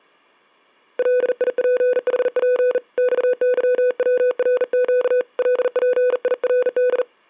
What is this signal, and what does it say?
Morse code (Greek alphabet), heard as a keyed tone, hand-sent with a bug key, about 40 wpm, 500 Hz. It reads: ΛΙΠΗΠ ΞΥΩΡΨ ΛΠΙΡΔ